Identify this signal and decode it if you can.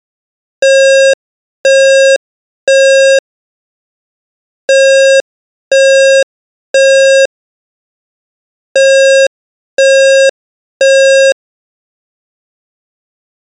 Alarm pattern, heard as an alarm's beeps, played three times, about 540 Hz. Temporal three. Smoke or fire, evacuate.